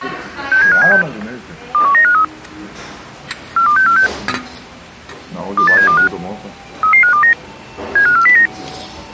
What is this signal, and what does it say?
Five-tone selective call (CCIR), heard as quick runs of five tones, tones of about 100 ms, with the noise of a restaurant. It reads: 67576 21953 42646 28725 33529 75409